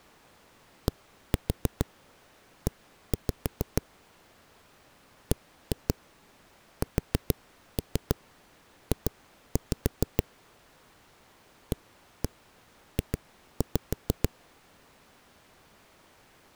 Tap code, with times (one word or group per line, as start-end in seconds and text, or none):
0.9-3.8 DE
5.3-10.2 BSJ
11.7-14.3 AJ